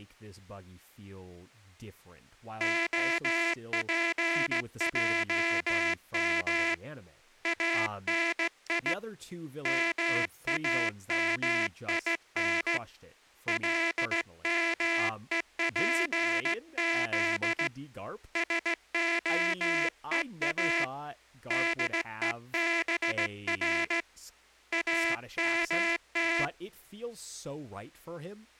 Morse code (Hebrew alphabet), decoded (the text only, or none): הפעם אני מאמין למופז שהוא דובר אמת